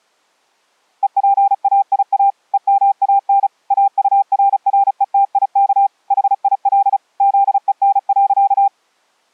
Morse code, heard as a keyed tone, machine-sent, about 35 wpm, 790 Hz. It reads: EPAIA EMAN AURRETIK HIL ZEN.